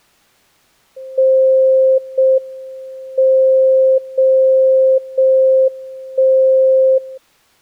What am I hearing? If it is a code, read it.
Radio time signal (JJY), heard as a tone whose level steps once a second, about 530 Hz. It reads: 0 M 0 0 1 0